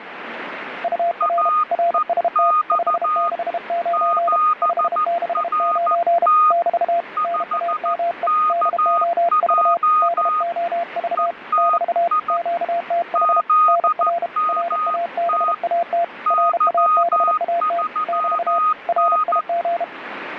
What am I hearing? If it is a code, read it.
Morse code, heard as two keyed tones, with radio static. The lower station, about 32 wpm, 690 Hz: UR RST 569 569 <BT> NAME DOV DOV <BT> QTH NR RABAT RABAT <BT> RIG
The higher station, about 14 wpm, 1240 Hz: AEX 7RT 5KJ ETI ZMT Y3N